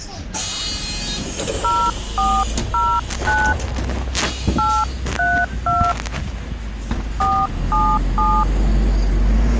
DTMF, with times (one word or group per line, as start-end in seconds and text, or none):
1.6-3.5 0409
4.6-5.9 832
7.2-8.4 477